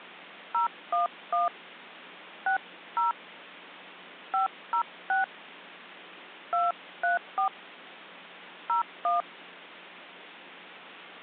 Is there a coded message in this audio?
Yes: DTMF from 0.5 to 9.2 s, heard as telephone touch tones, dialled by hand, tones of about 130 ms. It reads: 011 60 506 234 01